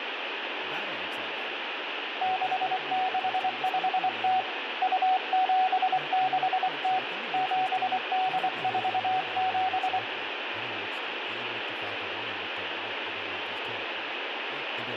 Morse code (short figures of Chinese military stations), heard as a keyed tone, hand-sent with a bug key, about 24 wpm, 750 Hz, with radio static, room echo and speech in English. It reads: 6650 2760 7847